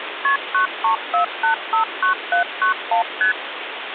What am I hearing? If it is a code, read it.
Multi-frequency trunk signalling (R1, as on North American trunks), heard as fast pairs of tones, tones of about 110 ms, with phone line noise. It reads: KP 934859791 ST